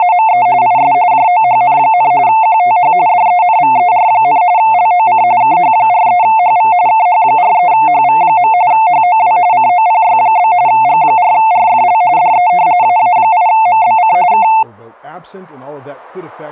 RTTY (45.45 baud, 170 Hz shift), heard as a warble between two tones, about 800 Hz centre, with static crashes and speech in English. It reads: … IS JOHN, QTH DENVER, LOC KH43HV KH43HV. HOW COPY? G4RFL DE AA8MBC K